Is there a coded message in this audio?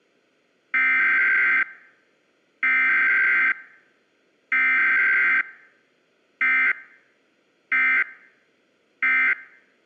Yes: Emergency Alert System (SAME) tones (header bursts, then end-of-message bursts) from 0.7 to 9.3 s, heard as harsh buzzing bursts, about 520.83 baud.